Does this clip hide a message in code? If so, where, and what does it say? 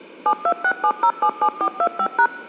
Yes: DTMF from 0.3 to 2.3 s, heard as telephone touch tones, dialled by machine, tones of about 70 ms. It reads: 7267077425#